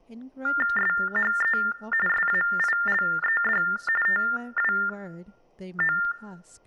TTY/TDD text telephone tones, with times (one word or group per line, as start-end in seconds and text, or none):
0.8-1.6 SHE
2.1-3.6 SAILED
4.1-6.0 TWO